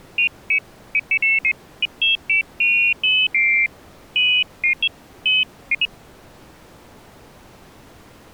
Pairs of high tones at irregular times. There is no code.